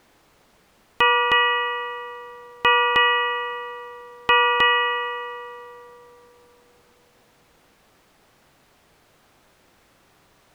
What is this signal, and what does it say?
Ship's bell, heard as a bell. 6. Six half-hours of the watch have passed.